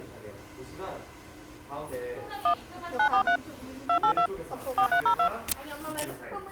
DTMF, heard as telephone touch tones, dialled by machine, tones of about 90 ms, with the noise of a crowd indoors. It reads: 1 943 282 4302